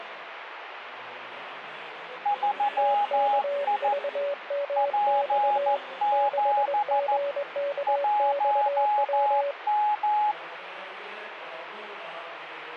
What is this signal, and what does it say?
Morse code, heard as two keyed tones, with radio static. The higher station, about 14 wpm, 830 Hz: 3I P7 1M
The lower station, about 21 wpm, 570 Hz: TKVMX 6GKXW